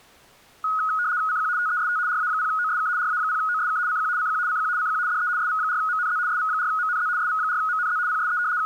RTTY (75 baud, 170 Hz shift), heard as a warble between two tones, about 1360 Hz centre. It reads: CQ TEST RA0OSK RA0OSK CQ CQ CQ CQ DE SV4MNZ SV4MNZ SV4MNZ PSE …